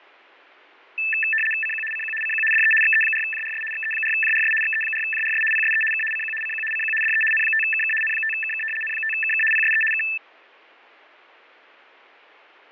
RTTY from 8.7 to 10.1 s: N5KK PSE K

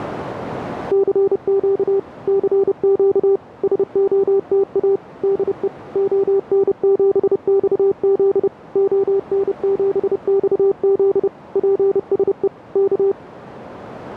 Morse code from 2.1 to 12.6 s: CQ SOTA DE ON7XZ ON7XZ PSE

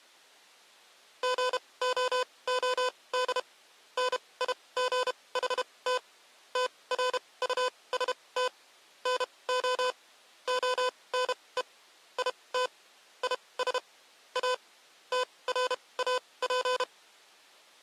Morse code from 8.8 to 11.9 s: NO ONE

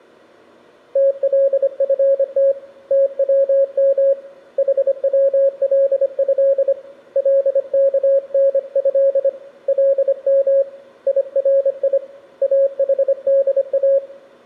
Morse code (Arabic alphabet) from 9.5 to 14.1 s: لم يري احدا

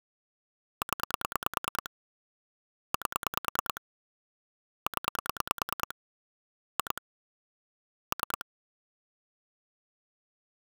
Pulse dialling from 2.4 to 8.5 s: 8 0 2 3

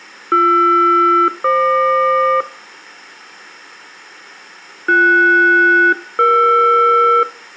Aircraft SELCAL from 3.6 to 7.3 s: BS-ER

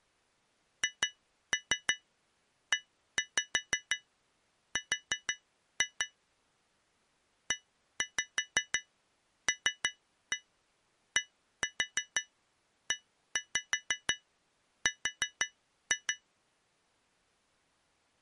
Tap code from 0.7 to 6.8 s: HER

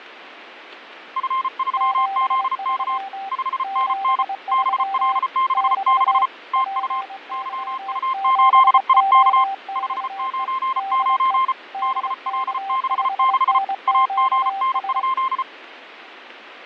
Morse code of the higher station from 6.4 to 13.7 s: TU YU8IK 599 BL66

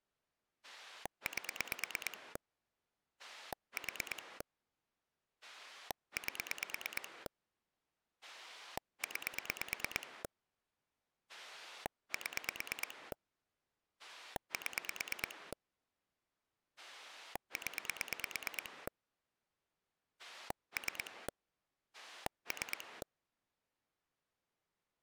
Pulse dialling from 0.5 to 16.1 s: 8 4 8 9 7 7

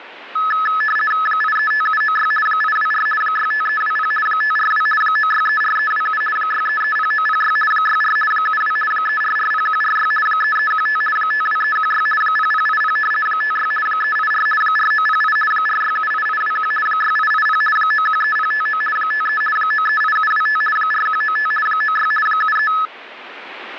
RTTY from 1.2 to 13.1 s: 835796 824 65320 542 9634327 6330906 64 72 3440146 3315 52316 0080

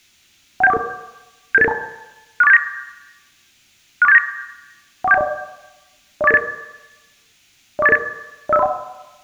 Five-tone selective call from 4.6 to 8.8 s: 14710 04888 04888 05031

